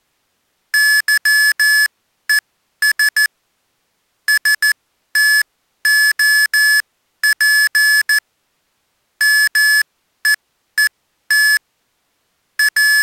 Morse code, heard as electronic beeps, machine-sent, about 14 wpm, spaced as for 11 wpm, 1700 Hz. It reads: YES STOP MEET …